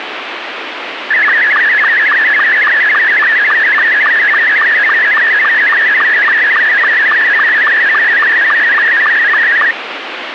SSTV (slow-scan television), Scottie S2, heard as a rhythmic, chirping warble, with radio static.